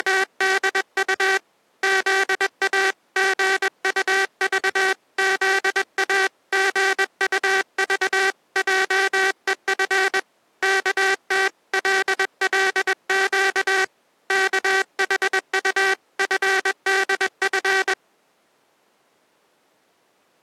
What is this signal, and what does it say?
Morse code (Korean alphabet), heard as a buzzer, hand-sent with a paddle, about 21 wpm. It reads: … 토실토실한 어깨 위는